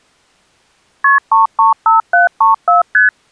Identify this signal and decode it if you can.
Multi-frequency trunk signalling (R1, as on North American trunks), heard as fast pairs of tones, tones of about 140 ms. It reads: KP 335734 ST